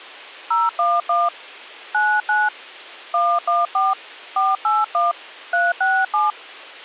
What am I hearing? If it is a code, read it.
DTMF, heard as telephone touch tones, dialled by hand, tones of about 210 ms. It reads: 011 99 114 481 367